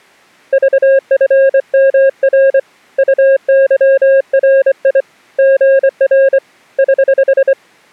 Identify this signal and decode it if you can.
Morse code, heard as a keyed tone, hand-sent with a straight key, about 24 wpm, 540 Hz. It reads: VFMR UYRI GR <HH>